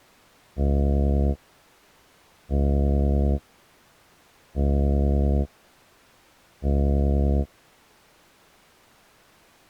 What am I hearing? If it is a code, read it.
Ship horn signal, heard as a ship's horn, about 70 Hz. 4 short. At sea: a pilot vessel's identity signal in fog.